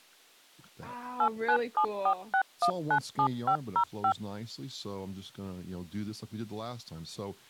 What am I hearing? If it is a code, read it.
DTMF, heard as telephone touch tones, dialled by machine, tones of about 80 ms, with speech in English. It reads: 89746197505